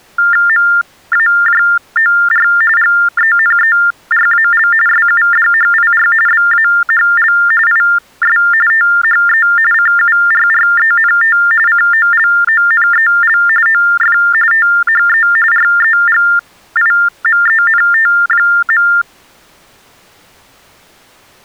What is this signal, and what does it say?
TTY/TDD text telephone tones (45.45 baud Baudot), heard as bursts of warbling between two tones, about 400 Hz shift, 1600 Hz centre. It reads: MAJOR GENERAL SUDHIR BAHL IS THE CURRENT COLONEL OF THE REGIMENT.